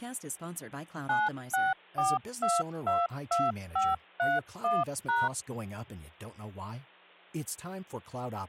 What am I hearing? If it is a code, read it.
DTMF, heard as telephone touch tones, dialled by machine, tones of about 200 ms, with hum and speech in English. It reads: 964222531#